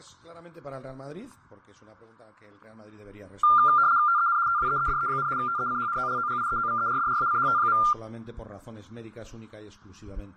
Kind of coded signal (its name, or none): RTTY